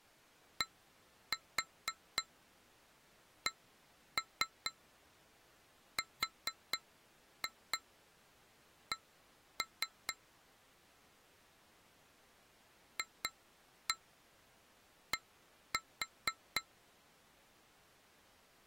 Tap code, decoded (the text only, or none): DCRC FD